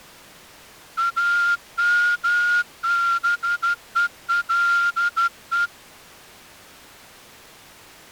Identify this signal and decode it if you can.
Morse code, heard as a whistle, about 13 wpm. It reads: AMBELE